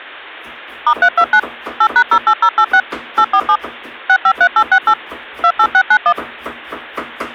DTMF, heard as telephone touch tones, dialled by machine, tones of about 70 ms, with kitchen noise. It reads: *329 8#08086 847 653868 28691